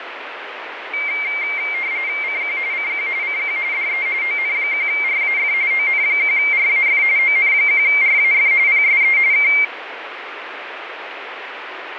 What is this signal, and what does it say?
RTTY (45.45 baud, 170 Hz shift), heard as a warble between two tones, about 2200 Hz centre, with radio static and fading. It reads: CQ CQ CQ DE ON1RAF ON1RAF ON1RAF PSE K